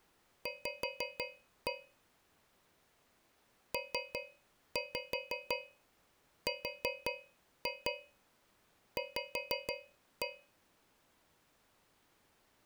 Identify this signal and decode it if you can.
Tap code, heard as taps on a metal pipe, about 5 knocks a second. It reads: V PRV